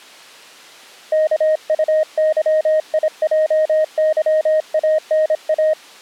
Morse code, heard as a keyed tone, hand-sent with a paddle, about 26 wpm, 620 Hz. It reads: KUYIJYANA